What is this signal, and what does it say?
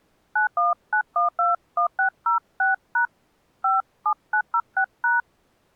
DTMF, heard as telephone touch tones, dialled by hand, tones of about 110 ms. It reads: 919121606# 57906#